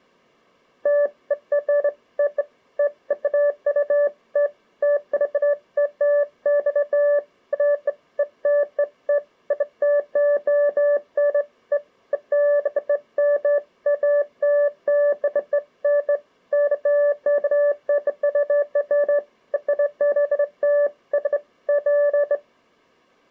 Beeps of irregular length. There is no code.